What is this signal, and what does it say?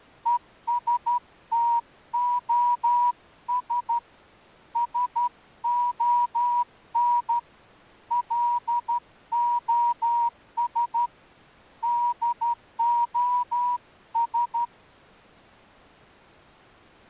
Morse code, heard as a whistle, hand-sent with a straight key, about 12 wpm. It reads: ESTOS SON LOS DOS